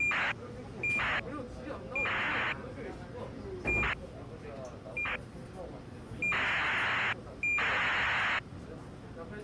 ACARS aircraft data, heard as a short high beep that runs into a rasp, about 2400 baud, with the noise inside a subway train.